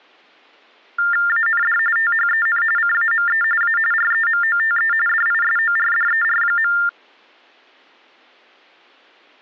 TTY/TDD text telephone tones (45.45 baud Baudot), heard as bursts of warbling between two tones, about 400 Hz shift, 1600 Hz centre. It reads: AND THEN CAME A REMOTE DISORDER.